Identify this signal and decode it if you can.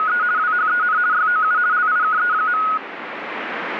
RTTY (50 baud, 170 Hz shift), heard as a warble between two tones, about 1360 Hz centre, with radio static. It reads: … WHEN YOU LIKE.